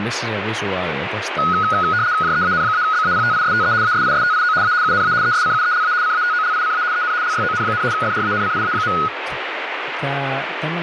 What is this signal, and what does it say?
RTTY (75 baud, 170 Hz shift), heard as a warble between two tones, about 1360 Hz centre, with radio static and speech in Finnish. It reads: JEAN-BAPTISTE ASISTIO A UNA ESCUELA CATOLICA EN LYON, FRANCIA.